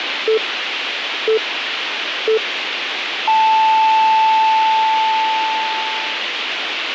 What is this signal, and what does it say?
Radio time signal (three low pips and a long one an octave up, as on NHK), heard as pips, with radio hiss.